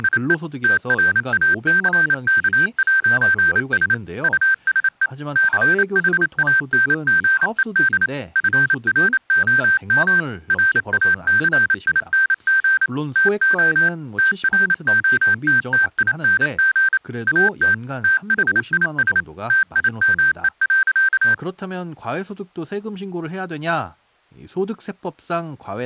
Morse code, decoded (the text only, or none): … TRACK'S USE CHANGED FROM RACING TO TROTTING AT THIS TIME.